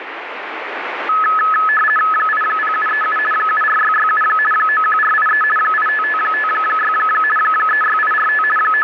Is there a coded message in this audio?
Yes: RTTY (50 baud, 450 Hz shift) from 1.1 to 8.8 s, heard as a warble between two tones, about 1500 Hz centre, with radio static. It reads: 80737 74667 91483 85556 36845 …